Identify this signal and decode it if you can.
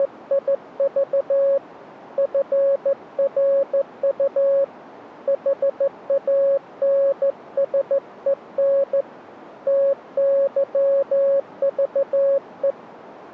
Morse code, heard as a keyed tone, hand-sent with a straight key, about 14 wpm, 550 Hz. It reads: … FRU HANSEN TYVE